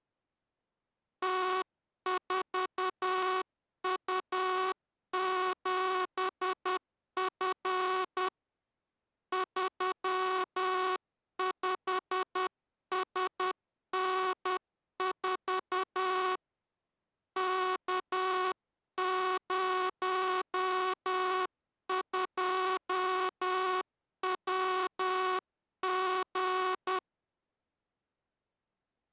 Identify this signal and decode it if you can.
Morse code, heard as a buzzer, hand-sent with a paddle, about 10 wpm. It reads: T4U7F 35SN4 K02WG